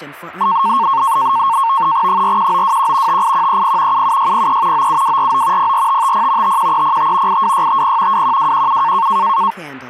NAVTEX (SITOR-B), 100 baud, 170 Hz shift, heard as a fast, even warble, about 1000 Hz centre, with speech in English. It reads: 41921 58130 77603 97249 04550 51305 82650 21217